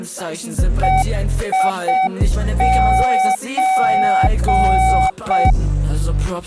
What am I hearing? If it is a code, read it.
Morse code (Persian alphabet), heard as a keyed tone, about 6 wpm, 760 Hz. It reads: هیچ